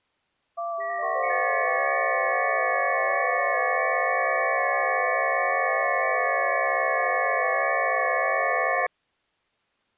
FT8 (several signals at once), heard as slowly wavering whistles, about 6.25 baud.